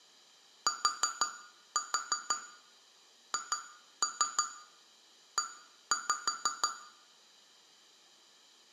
Tap code, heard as taps on glass, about 6 knocks a second, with room echo. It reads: THE